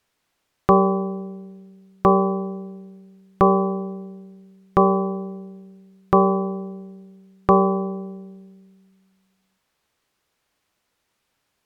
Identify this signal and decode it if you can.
Clock strike, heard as a bell. 6. Six o'clock.